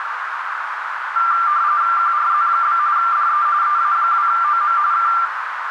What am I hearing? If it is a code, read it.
RTTY (45.45 baud, 170 Hz shift), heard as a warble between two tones, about 1280 Hz centre, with radio static and a narrow filter. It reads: QRZ? DE EA2OM K